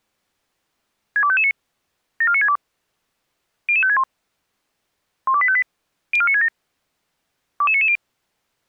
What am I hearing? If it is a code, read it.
Five-tone selective call (ZVEI), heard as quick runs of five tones, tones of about 70 ms. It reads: 62559 74962 00561 12858 04967 22990